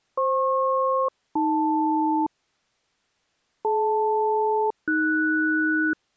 Aircraft SELCAL, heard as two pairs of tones. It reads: FP-AL DL-AS